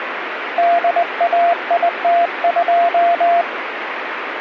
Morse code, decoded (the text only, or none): DAIT2